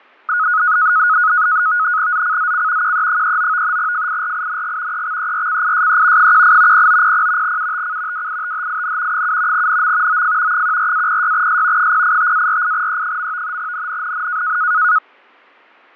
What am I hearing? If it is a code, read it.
NAVTEX (SITOR-B), 100 baud, 170 Hz shift, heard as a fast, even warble, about 1360 Hz centre, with fading. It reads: ZCZC QE39 FIRING EXERCISE 18 0900 UTC WITHIN 7 NM OF 14-06S 085-48E. NNNN